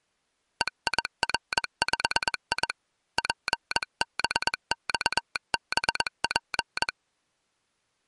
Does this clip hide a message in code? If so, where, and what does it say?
Yes: Morse code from 0.6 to 6.9 s, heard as a telegraph sounder, hand-sent with a paddle, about 21 wpm. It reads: EIR5I PBXBP